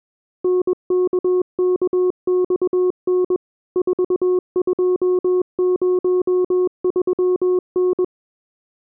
Morse code, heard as a keyed tone, machine-sent, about 21 wpm, 360 Hz. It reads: NKKXN 4203N